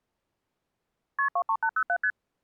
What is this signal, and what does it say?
Multi-frequency trunk signalling (R1, as on North American trunks), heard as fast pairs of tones, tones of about 70 ms. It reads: KP 23807 ST